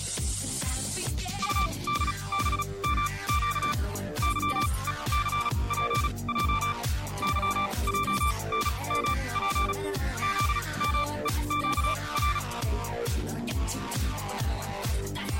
Morse code, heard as a keyed tone, machine-sent, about 36 wpm, spaced as for 25 wpm, 1180 Hz. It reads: UDBMQ YECPJ YJNMP ZMEQR